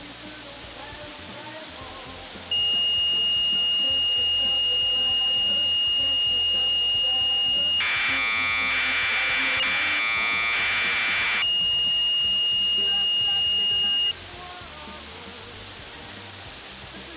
Commodore tape loading (standard loader), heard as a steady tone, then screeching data.